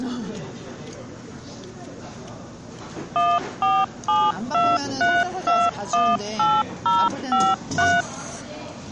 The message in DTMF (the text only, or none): 14723218053